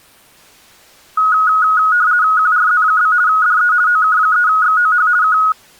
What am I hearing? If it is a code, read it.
RTTY (50 baud, 170 Hz shift), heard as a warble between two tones, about 1360 Hz centre. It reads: QRZ? DE OK3XOH K